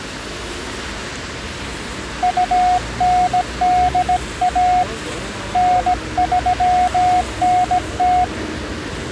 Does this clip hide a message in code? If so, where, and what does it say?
Yes: Morse code (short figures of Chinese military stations) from 2.2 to 8.3 s, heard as a keyed tone, hand-sent with a bug key, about 17 wpm, 730 Hz, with street noise. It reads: 2981 9390